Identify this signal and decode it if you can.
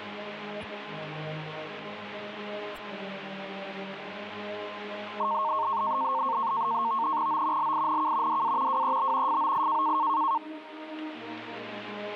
NAVTEX (SITOR-B), 100 baud, 170 Hz shift, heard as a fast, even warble, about 1000 Hz centre. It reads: O LINK DA WEB FOI